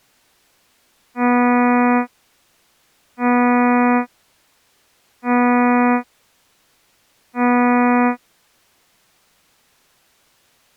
Ship horn signal, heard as a ship's horn, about 240 Hz. 4 short. At sea: a pilot vessel's identity signal in fog.